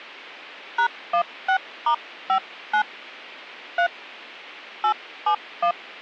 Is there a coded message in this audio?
Yes: DTMF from 0.8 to 5.7 s, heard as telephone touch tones, dialled by hand, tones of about 90 ms. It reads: #16*59 3 871